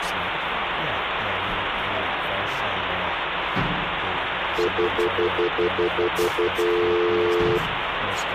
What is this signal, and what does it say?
Telephone call progress tone (North American plan), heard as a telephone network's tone, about 350, 440 Hz, 0.1 s on and 0.1 s off, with phone line noise. Stutter dial tone.